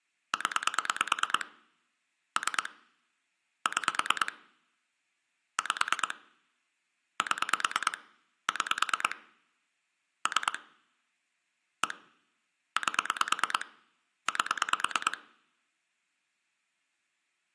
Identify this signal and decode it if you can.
Pulse dialling, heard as clicks on a phone line, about 9 pulses a second, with room echo. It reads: 0 3 6 5 7 6 3 1 8 8